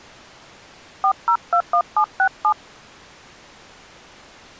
DTMF, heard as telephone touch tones, dialled by hand, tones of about 80 ms. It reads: 4021767